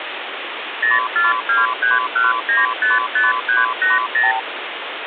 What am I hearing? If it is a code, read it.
Multi-frequency trunk signalling (R2, with the far end's replies), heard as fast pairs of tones, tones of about 170 ms, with phone line noise. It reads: 04231955380